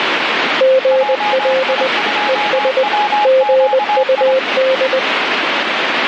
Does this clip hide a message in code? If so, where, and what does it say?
Yes: Morse code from 0.5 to 5.0 s, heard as two keyed tones, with radio static. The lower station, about 20 wpm, 520 Hz: GL ES GUD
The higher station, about 25 wpm, 840 Hz: JI2WQI